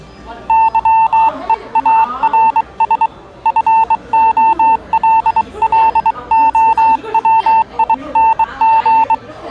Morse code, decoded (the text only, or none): YEARS FOLLOWING